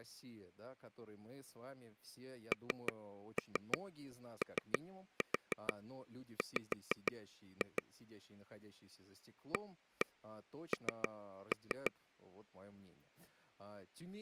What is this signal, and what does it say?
Tap code, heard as taps on a table, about 6 knocks a second, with speech in Russian. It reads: NOW AN